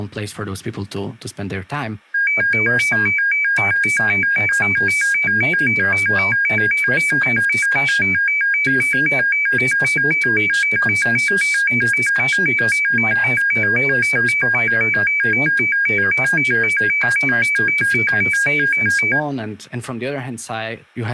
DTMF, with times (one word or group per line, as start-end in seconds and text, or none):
none